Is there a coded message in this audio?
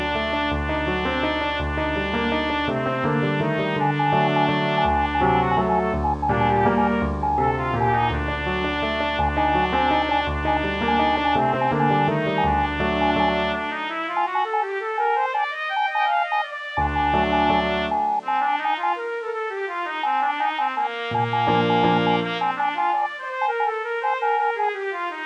Yes: Morse code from 3.7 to 24.7 s, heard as a keyed tone, hand-sent with a paddle, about 13 wpm, 840 Hz. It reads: RZFTT PEQTI SNRWZ BPUIR